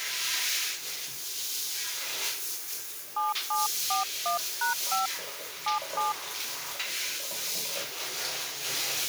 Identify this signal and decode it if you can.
DTMF, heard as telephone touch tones, dialled by hand, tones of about 140 ms, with the noise of a restroom. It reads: 7741#5 77